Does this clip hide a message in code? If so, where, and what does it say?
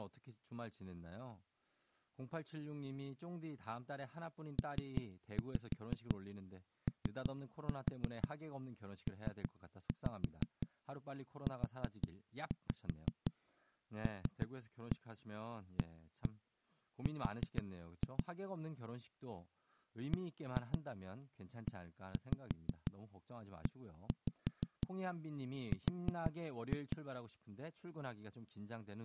Yes: tap code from 4.6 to 27.0 s, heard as knocks on a wall, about 6 knocks a second, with speech in Korean. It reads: POPULAR BEER